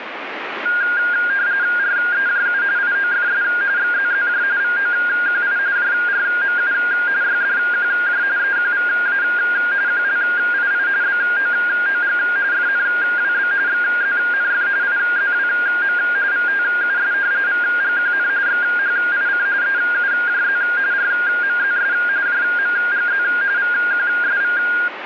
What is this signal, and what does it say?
RTTY (45.45 baud, 170 Hz shift), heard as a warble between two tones, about 1500 Hz centre, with radio static. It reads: REJU IOFS XZZJ VOQI JRMU YDQJ EQVA QLII BOOG FNWB XZNF IZWM VTUS VGQN XHIC EUJZ RMZS JMGZ VQSV